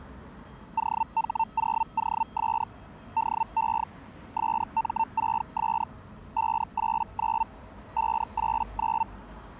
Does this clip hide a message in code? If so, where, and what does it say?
Yes: Hellschreiber (Feld-Hell, 122.5 baud) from 0.8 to 9.0 s, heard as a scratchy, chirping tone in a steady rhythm, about 900 Hz, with the noise of a residential street. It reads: OH0OS DE SM6S 589 589